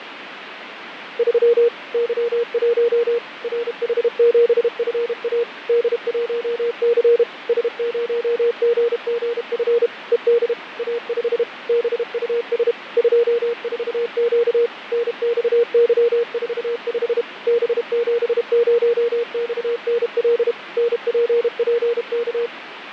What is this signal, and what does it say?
Morse code, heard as a keyed tone, machine-sent, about 32 wpm, 470 Hz, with radio static and fading. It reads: 3 Y1 RH7FA D1C S0GGF ED A5 BUS 24Q NXY45 B70XNL NPPK